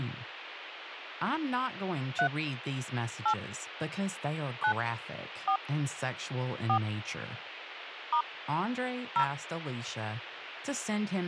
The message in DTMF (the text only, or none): 3 8 9 4 4 * 0